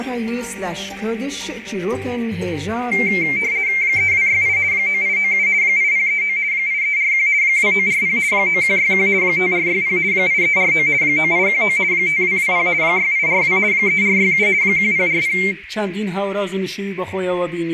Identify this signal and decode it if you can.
RTTY (50 baud, 170 Hz shift), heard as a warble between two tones, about 2200 Hz centre, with radio static and a narrow filter. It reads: 3268 9897 8039 8341 2940 9161 5460 8349 9819 5220 6842 3467 1040